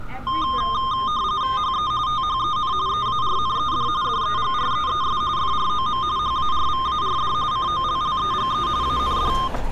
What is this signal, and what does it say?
RTTY (45.45 baud, 170 Hz shift), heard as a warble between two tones, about 1140 Hz centre, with street noise. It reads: HE THEN EARNED DEGREES FROM HARVARD COLLEGE AND